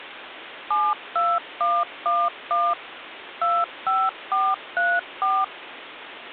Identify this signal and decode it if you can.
DTMF, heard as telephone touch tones, dialled by machine, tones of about 230 ms, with phone line noise. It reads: 72111 25434